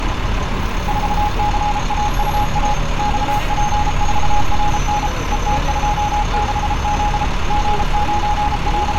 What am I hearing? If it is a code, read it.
Morse code, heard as a keyed tone, machine-sent, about 33 wpm, 830 Hz, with street noise. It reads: 4CAUA XP4RN ET26Z …